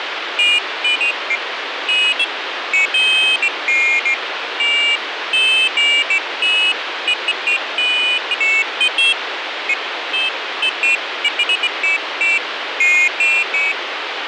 Pairs of high tones at irregular times, with radio static. There is no code.